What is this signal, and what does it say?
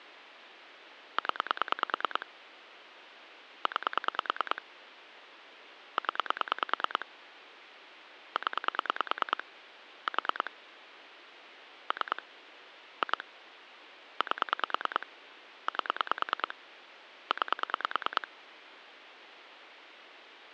Pulse dialling, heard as clicks on a phone line, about 9 pulses a second. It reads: 0 9 0 0 4 3 2 8 8 9